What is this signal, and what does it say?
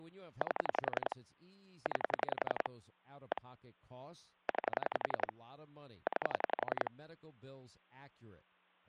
Pulse dialling, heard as clicks on a phone line, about 11 pulses a second, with speech in English. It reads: 8 9 1 9 9